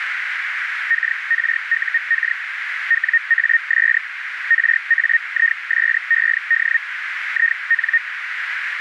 Hellschreiber (Feld-Hell, 122.5 baud), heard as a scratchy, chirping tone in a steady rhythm, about 1850 Hz, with radio static and a narrow filter. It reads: KRUK WAS RAISED IN